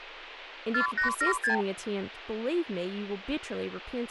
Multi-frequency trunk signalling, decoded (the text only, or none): 4876